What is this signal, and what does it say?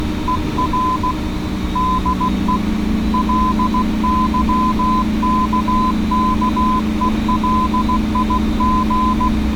Morse code, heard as a keyed tone, hand-sent with a paddle, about 16 wpm, 1020 Hz, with street noise. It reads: ER DE LYKKELIG